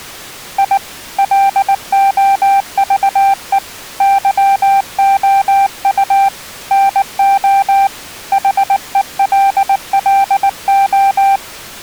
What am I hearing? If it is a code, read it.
Morse code, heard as a keyed tone, hand-sent with a paddle, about 19 wpm, 790 Hz. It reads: I LOVE YOU NO HELLO